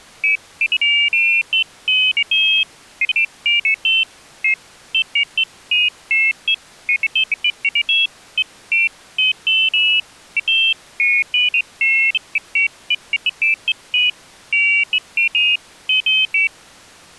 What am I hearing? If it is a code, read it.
Pairs of high tones at irregular times. There is no code.